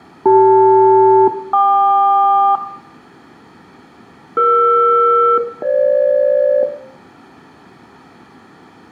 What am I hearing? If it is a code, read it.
Aircraft SELCAL, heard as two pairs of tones, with room echo. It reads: CL-KQ ER-FG